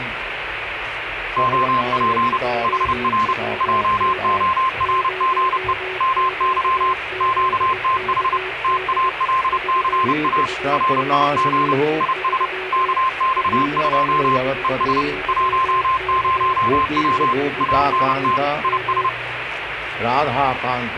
Morse code, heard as a keyed tone, machine-sent, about 30 wpm, 1050 Hz, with radio static and a weaker station near 370 Hz. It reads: OP HR JORGE MY QTH TALCA RIG IS KX2 ES 10W ANT IS